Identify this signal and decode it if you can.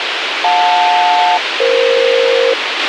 Aircraft SELCAL, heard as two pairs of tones, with radio hiss and a squelch burst at the end. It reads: JL-EF